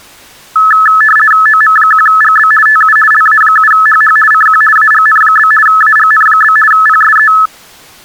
RTTY (50 baud, 450 Hz shift), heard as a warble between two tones, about 1500 Hz centre. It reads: OM1GB TU LA7HH CQ AGN? AGN? PSE